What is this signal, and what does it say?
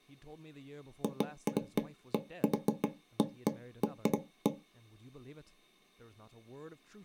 Irregular knocks on wood, with speech in English. There is no code.